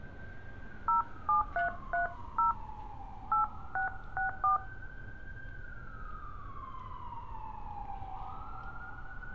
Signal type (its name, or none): DTMF